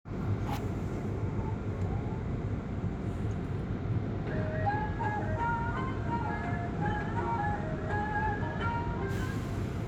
The noise inside a subway train. There is no code.